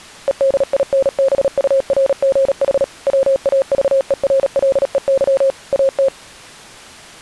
Morse code, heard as a keyed tone, machine-sent, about 37 wpm, 540 Hz. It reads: EDINBURGH WAVERLEY AT